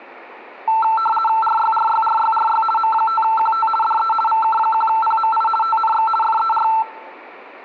RTTY (50 baud, 450 Hz shift), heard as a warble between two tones, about 1110 Hz centre. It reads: RYRYRYRY M5QT DE VK1PMI TNX FER